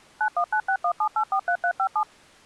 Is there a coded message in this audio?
Yes: DTMF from 0.2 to 2.0 s, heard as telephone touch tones, dialled by machine, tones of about 80 ms. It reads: 919617843357